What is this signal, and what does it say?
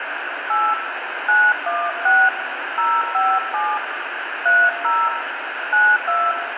DTMF, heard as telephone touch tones, dialled by hand, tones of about 240 ms, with radio hiss and room echo. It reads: 8 916 057 30 92